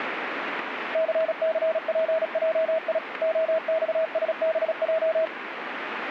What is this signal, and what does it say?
Morse code, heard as a keyed tone, machine-sent, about 36 wpm, 640 Hz, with radio static. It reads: CCPJI OXSBJ